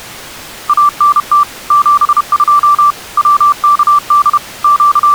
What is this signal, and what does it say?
Morse code, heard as a keyed tone, machine-sent, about 31 wpm, 1170 Hz. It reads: ANT 72 WKD …